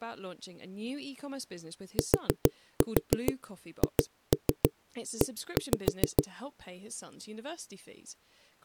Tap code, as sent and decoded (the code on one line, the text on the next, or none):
4-4 2-3 1-5
THE